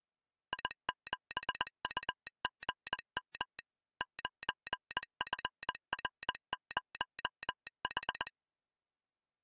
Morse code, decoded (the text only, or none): I7UGM 9FR0H